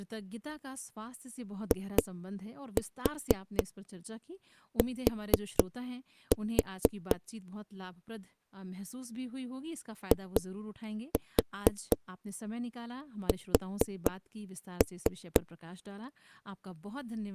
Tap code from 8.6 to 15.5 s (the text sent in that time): IS